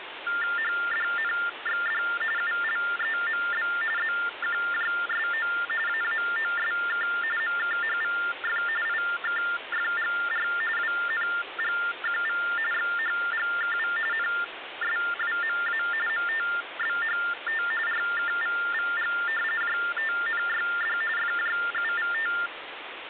TTY/TDD text telephone tones (45.45 baud Baudot), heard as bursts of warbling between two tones, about 400 Hz shift, 1600 Hz centre, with phone line noise. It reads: HDNXD ULEMB ZQJSO AAOSK MKHVF IKFGR WNGQV XHGKV NSWMA MTBHT RKVVG JTNYD FJUVT